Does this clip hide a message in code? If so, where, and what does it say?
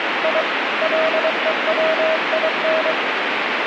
Yes: Morse code (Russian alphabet) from 0.2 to 3.0 s, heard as a keyed tone, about 23 wpm, 640 Hz, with radio static. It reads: И ЛЕВИН